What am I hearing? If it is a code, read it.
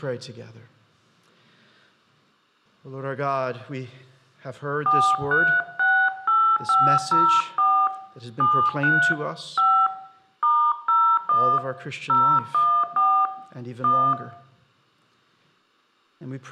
DTMF, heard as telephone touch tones, dialled by hand, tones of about 290 ms, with room echo. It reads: 4368504 73 5 *01 014 1